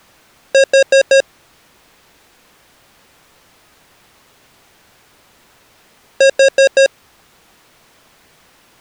Alarm pattern, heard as an alarm's beeps, played twice, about 540 Hz. Temporal four. Carbon monoxide.